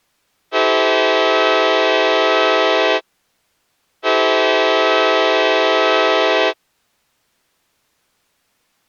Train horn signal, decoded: 2 long

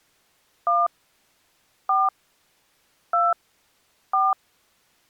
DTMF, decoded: 1 4 2 4

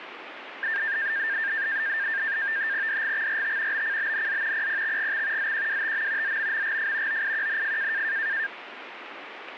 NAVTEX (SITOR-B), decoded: DGXRT BCBNZ PPXGX ZQWTM ZMMGF OIQNF

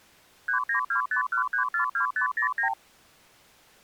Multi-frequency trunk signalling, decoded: 39251342509

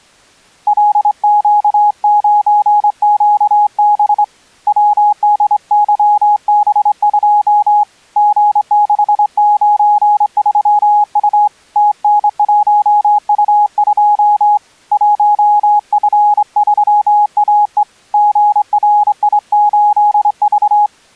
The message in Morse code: LQ9QB WDYB2 G693U TN1U2 1F3AE GRI8V

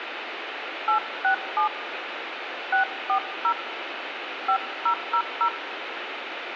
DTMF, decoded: 867 640 5000

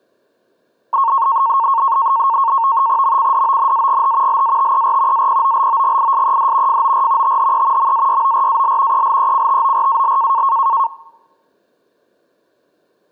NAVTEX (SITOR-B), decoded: MCDONAGH LATER APOLOGISED FOR THE MAYORAL ELECTORAL

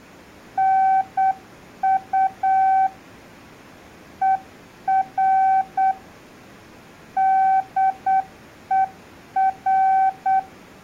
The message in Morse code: NU ER DER

